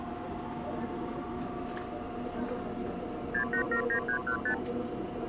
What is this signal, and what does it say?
Multi-frequency trunk signalling (R2, with the far end's replies), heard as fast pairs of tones, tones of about 90 ms, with the noise inside a subway train. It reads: 6879315